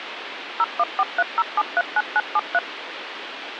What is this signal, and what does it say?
DTMF, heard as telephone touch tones, dialled by machine, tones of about 40 ms, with phone line noise. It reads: 01430739973